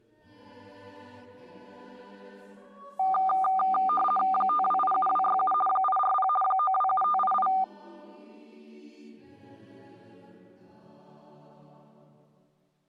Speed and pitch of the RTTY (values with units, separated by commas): 50 baud, 450 Hz shift, 980 Hz centre